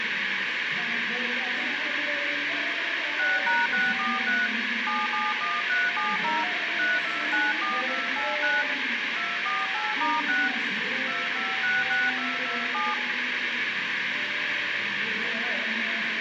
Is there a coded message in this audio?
Yes: DTMF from 3.2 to 12.9 s, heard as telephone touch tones, dialled by hand, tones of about 200 ms, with radio hiss. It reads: 6#643 771370 3294289 248*6 2566227